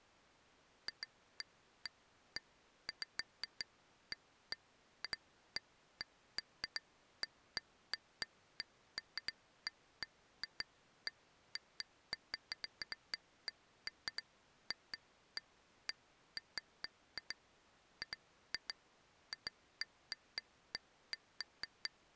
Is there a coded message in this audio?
No, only irregular taps on glass.